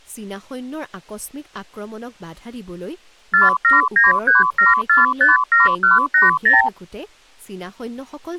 Multi-frequency trunk signalling (R2, with the far end's replies), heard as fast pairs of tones, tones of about 160 ms, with speech in Assamese. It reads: 47937457180